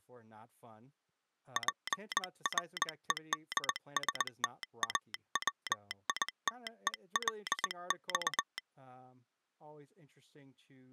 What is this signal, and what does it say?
Morse code (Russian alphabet), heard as a telegraph sounder, hand-sent with a paddle, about 20 wpm, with speech in English. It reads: ПРЕДСТАВИТЕЛЬ